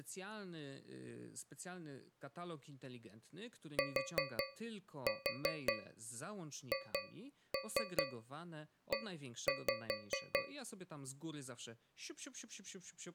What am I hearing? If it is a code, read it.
Tap code, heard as taps on a metal pipe, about 5 knocks a second, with speech in Polish. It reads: THE